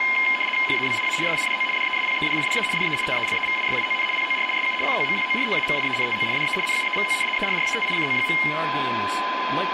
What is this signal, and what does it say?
RTTY (75 baud, 850 Hz shift), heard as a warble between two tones, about 2550 Hz centre, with radio static, a steady whistle near 1020 Hz and speech in English. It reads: HABIA SIDO DESPEDIDA DE TELEVISION POR SU COMPORTAMIENTO DE NUEVO ERRATICO.